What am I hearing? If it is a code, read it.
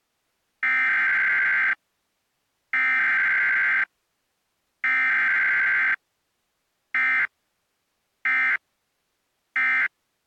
Emergency Alert System (SAME) tones (header bursts, then end-of-message bursts), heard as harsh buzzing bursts, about 520.83 baud.